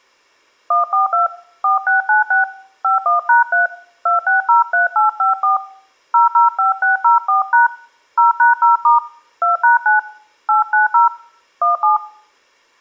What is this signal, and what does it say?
DTMF, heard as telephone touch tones, dialled by hand, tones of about 140 ms. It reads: 142 4696 51#3 2603854 005604# 0#0* 2#9 890 17